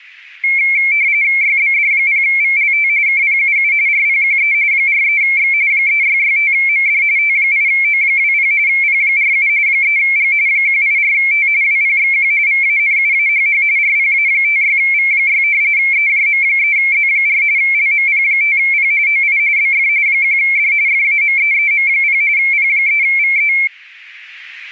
RTTY (45.45 baud, 170 Hz shift), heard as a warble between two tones, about 2250 Hz centre. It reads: YBD0VLT KPUU RPQE 43X 3665MD T8O20 P47 3G 184T WPXQ VANUAHH RPA56V6 EJM3Z4 LMP5P OI BF 1D FAMEEM0 P3VE